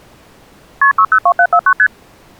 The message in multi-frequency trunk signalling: KP 602749 ST

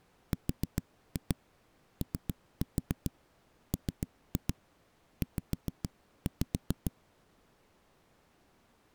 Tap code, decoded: ROMZ

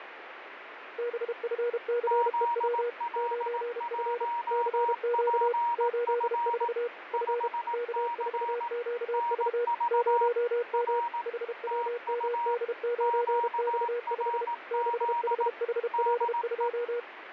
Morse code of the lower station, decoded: BFCEW 9F CQ 84 F K4QV 0M HWMD9X5 6HHL2

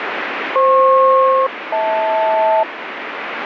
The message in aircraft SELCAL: FP-HL

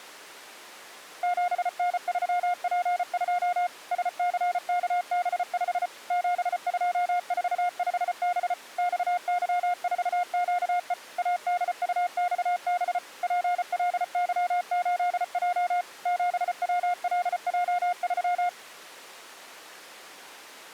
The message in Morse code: 7N3P2 SCKB5 7245B XY4QE ADUXB PLY8J 7WLJ3

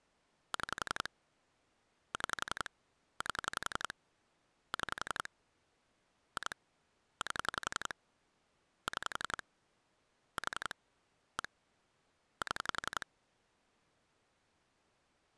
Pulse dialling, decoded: 6 6 8 6 2 8 6 4 1 7

